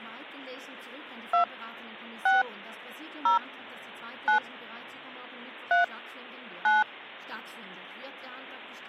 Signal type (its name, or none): DTMF